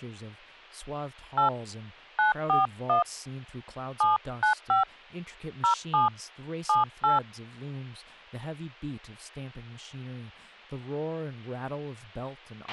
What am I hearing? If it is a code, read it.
DTMF, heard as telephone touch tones, dialled by hand, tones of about 130 ms, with a squelch burst at the end and speech in English. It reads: 8 941 795 07 78